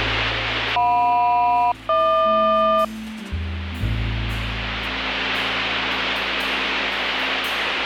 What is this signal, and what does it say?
Aircraft SELCAL, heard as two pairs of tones. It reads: JM-HQ